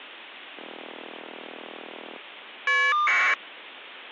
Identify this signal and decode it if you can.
Caller ID data burst, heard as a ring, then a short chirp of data, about 1200 baud.